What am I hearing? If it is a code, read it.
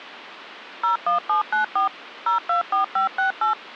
DTMF, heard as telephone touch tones, dialled by machine, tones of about 120 ms. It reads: 01794 024568